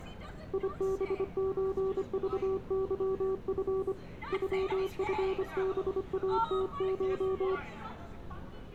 Morse code (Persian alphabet), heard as a keyed tone, hand-sent with a paddle, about 25 wpm, 380 Hz, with street noise. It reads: یبچذظف غفباتش